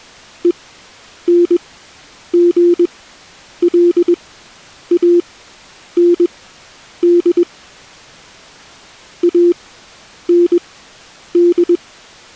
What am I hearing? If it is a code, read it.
Morse code, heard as a keyed tone, machine-sent, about 21 wpm, spaced as for 9 wpm, 350 Hz. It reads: ENGLAND AND